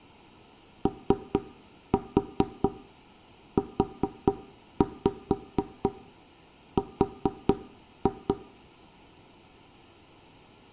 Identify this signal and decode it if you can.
Tap code, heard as knocks on wood, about 4 knocks a second, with room echo. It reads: OUR